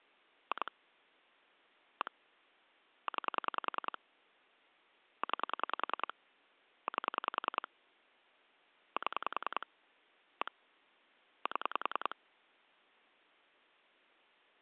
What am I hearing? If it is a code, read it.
Pulse dialling, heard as clicks on a phone line, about 10 pulses a second. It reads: 2 1 9 9 8 7 1 7